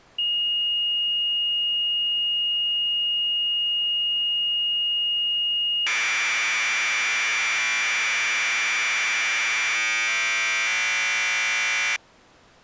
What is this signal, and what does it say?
Commodore tape loading (standard loader), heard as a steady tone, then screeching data.